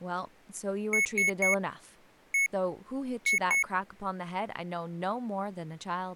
Beep code, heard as beeps from a small speaker, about 2200 Hz, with speech in English. 3-1-2. In Phoenix BIOS tables: DMA register failure.